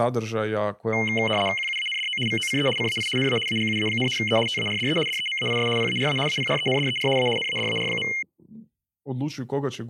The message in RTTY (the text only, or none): QUANDO VOCE CAI NA AGUA, E TARDE DEMAIS PARA APRENDER A NADAR.